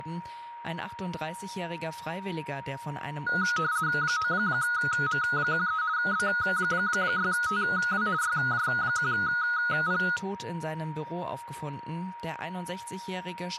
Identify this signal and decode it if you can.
RTTY (50 baud, 170 Hz shift), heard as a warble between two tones, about 1360 Hz centre, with static crashes, a steady whistle near 940 Hz and speech in German. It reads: 9M13 B6TW YJ1P